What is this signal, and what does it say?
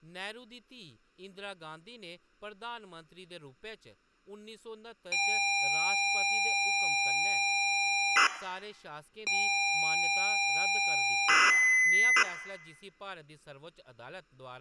ZX Spectrum tape loading, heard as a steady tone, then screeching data, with speech in Dogri.